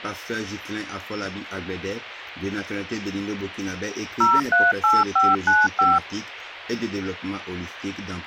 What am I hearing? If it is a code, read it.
DTMF, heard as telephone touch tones, dialled by machine, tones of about 200 ms. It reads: 038595